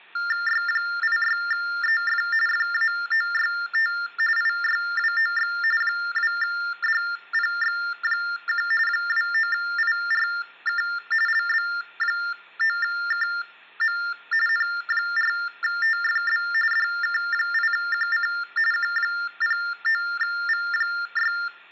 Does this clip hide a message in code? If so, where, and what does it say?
Yes: TTY/TDD text telephone tones (45.45 baud Baudot) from 0.2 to 21.5 s, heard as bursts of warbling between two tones, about 400 Hz shift, 1600 Hz centre, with hum and room echo. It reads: Y86EF FAOYT IYWOX 2DPX1 29IRK LB9KM N4TFB DK8QC Q09V6